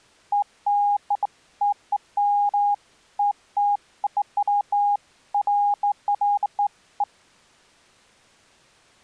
Beeps of irregular length. There is no code.